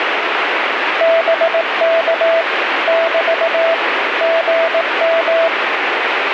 Morse code, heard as a keyed tone, machine-sent, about 18 wpm, 660 Hz, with radio static. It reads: BK <BT> GM